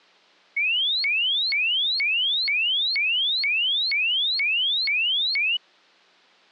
A tone that sweeps in pitch again and again. There is no code.